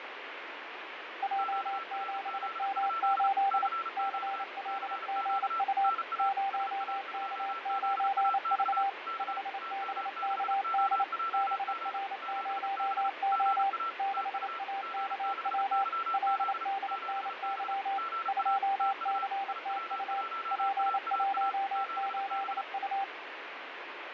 Morse code, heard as two keyed tones, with radio static and fading. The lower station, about 28 wpm, 790 Hz: J7M8 CLGU 0K9V 5BKD BR0O 6AKW LDNY 2CTU P18U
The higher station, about 35 wpm, 1340 Hz: QRZ? CQ CQ NA SA2ZAX K TM6OJG 7B GA TU G6YZ 7B GA TU IW1AAA 7B